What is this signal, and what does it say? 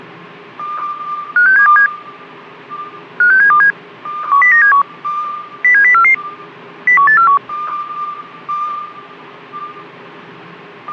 Five-tone selective call (CCIR), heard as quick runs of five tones, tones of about 100 ms. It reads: 56727 56727 10971 07044 01841